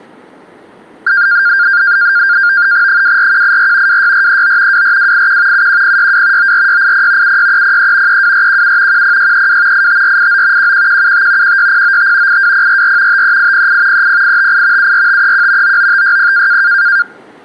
NAVTEX (SITOR-B), 100 baud, 170 Hz shift, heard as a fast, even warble, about 1500 Hz centre. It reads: 24184 26439 24281 71062 94680 76303 32417 10632 85489 11175 16095 82044 53808 30858 74531 99560